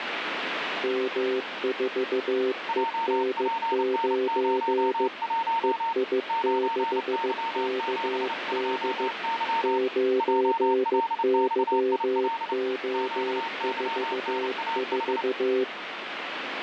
Morse code, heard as two keyed tones, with radio static. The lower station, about 15 wpm, 390 Hz: M4EN9 EI6KD 9YO44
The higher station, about 29 wpm, 910 Hz: JPN01 9Y72Y JLXIL QYNAH